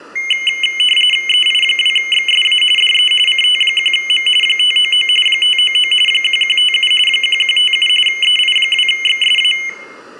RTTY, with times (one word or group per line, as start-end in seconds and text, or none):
1.3-2.6 EI2XSA
2.8-3.1 DE
3.3-4.3 CT1M
4.4-5.1 599
5.3-5.9 599
6.1-6.9 1157
7.1-7.9 1157
8.1-9.5 EI2XSA